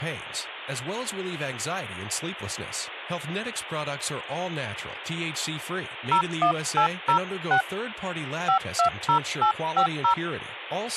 DTMF, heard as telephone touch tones, dialled by hand, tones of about 100 ms, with speech in English. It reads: 01806 520850